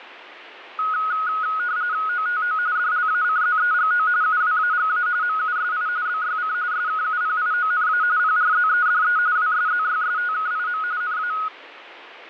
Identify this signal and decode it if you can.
RTTY (45.45 baud, 170 Hz shift), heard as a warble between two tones, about 1360 Hz centre. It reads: OTO DLACZEGO UWAGA MUSI BYC SKUPIONA PRZEDE WSZYSTKIM NA